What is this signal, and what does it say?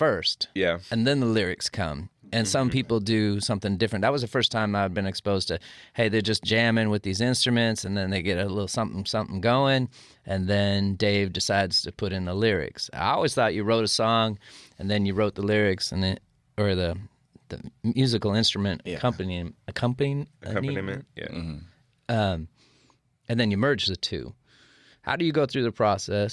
Speech in English. There is no code.